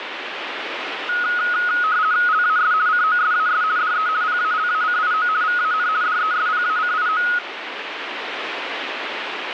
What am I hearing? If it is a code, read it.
RTTY (50 baud, 170 Hz shift), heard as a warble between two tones, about 1360 Hz centre, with radio static. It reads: LAS COSAS DE PALACIO VAN DESPACIO